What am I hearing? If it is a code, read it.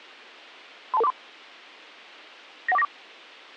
Five-tone selective call (EIA), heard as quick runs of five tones, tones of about 30 ms. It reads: 32243 91494